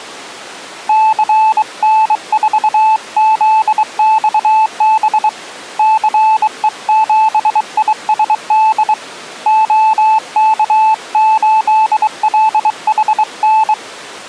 Morse code, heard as a keyed tone, hand-sent with a bug key, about 23 wpm, 870 Hz. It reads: CN4ZXB CE7ISD OK8LHN